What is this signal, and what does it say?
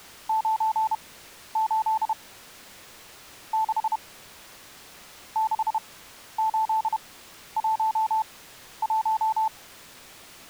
Morse code, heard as a keyed tone, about 31 wpm, spaced as for 12 wpm, 880 Hz. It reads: 98 6 6811